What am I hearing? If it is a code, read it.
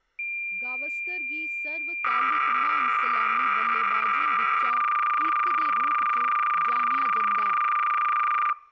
Cassette data (Kansas City type), 300 baud, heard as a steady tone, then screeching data, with speech in Dogri.